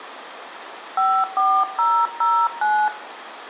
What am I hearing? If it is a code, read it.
DTMF, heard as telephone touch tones, dialled by hand, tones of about 270 ms, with phone line noise and room echo. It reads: 54009